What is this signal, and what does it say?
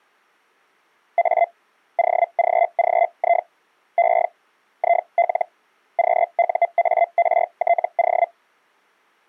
Hellschreiber (Feld-Hell, 122.5 baud), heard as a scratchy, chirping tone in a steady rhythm, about 690 Hz. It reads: A OGGI E IL QUARTO